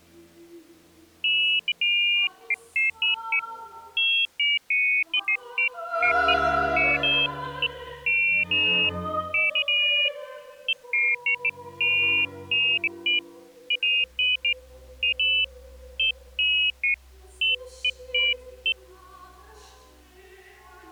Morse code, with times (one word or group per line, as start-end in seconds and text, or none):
none